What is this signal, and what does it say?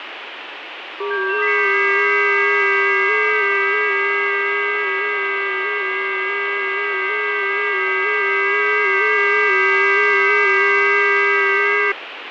FT8 (several signals at once), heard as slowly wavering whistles, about 6.25 baud, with radio static.